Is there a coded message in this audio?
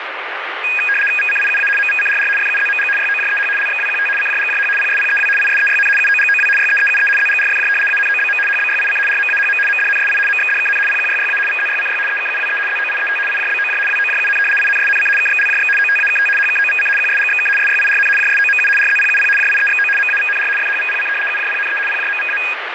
Yes: RTTY (75 baud, 850 Hz shift) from 0.6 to 22.5 s, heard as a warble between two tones, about 2050 Hz centre, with radio static. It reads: VCIUA MVCRR FUZMG YOJEH LXWQT CJGJH PSPEW ISEYN UOGOW YEEUE ZGRFJ ANOBM HBYIC RMAHM MDNSI MXDKN PQYYA VZYCY EKUWE ZOIET IJBOJ WOJUN INSNC KXLJX OTAKT HKOVC QSGXK SYIRN JSOMU RZPUP JIEXO MAVNR FHVPC UJPNE PJMVA